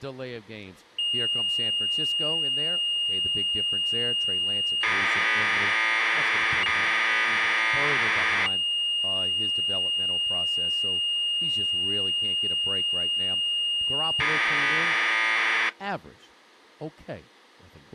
Commodore tape loading (standard loader), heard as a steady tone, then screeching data, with speech in English.